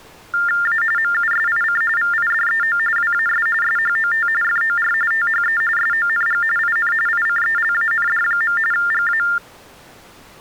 TTY/TDD text telephone tones (45.45 baud Baudot), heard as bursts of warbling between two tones, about 400 Hz shift, 1600 Hz centre. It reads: A MUSIC VIDEO WAS SHOT FOR THE SONG IN ICELAND. GA